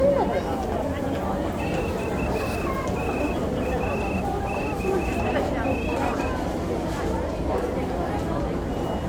Morse code, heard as a whistle, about 14 wpm, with the noise of a crowd indoors. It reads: XTAKD